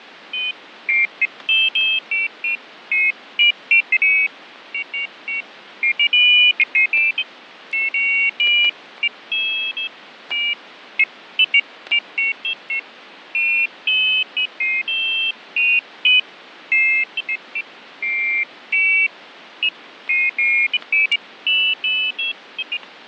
Pairs of high tones at irregular times, with radio static, fading and static crashes. There is no code.